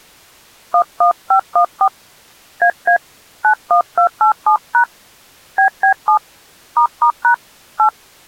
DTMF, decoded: 11514 AA 91287# BB7 **# 8

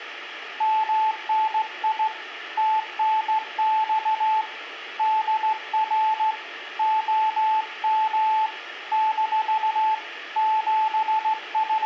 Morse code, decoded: MNI TNX DR OM - …

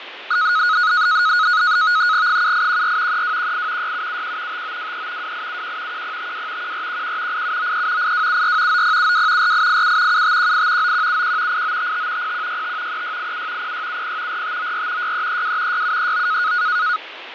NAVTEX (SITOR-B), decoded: 7814 3218 6771 5923 2871 1052 1411 8793 8274 9072 4887 7518 9171 8955 0165 3687 0670 4594 6332 6739

